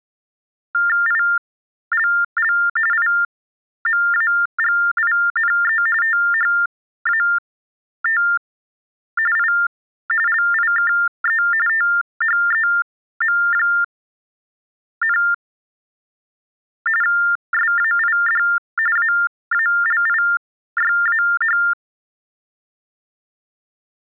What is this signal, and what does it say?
TTY/TDD text telephone tones (45.45 baud Baudot), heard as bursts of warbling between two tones, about 400 Hz shift, 1600 Hz centre. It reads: ILL IMAGINE THAT I LIKE THEM, SAID AALIYAH